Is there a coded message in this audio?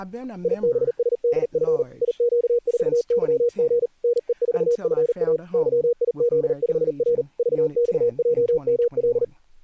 Yes: Morse code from 0.4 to 9.3 s, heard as a keyed tone, hand-sent with a paddle, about 39 wpm, 480 Hz, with speech in English. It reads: IBSDF IQ4YG NE4FA YIZ5R VXJML